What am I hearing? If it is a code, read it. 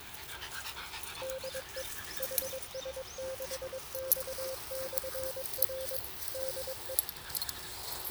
Morse code, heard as a keyed tone, machine-sent, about 22 wpm, 530 Hz, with the noise of a park. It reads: DE HS6X/R DE